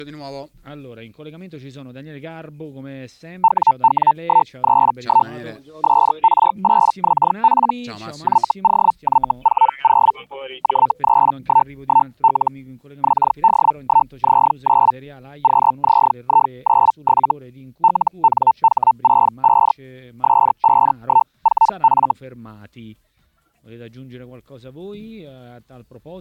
Hellschreiber (Feld-Hell, 122.5 baud), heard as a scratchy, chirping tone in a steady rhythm, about 900 Hz. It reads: WW131 SR8XP YOY40 J311L XD1Z9 QZI97 LNH65 S514F